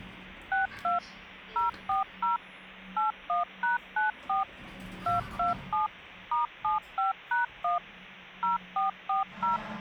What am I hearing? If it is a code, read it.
DTMF, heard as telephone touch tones, dialled by machine, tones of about 140 ms, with the noise inside a lift. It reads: 62 040 81#94 227 *75#1 0440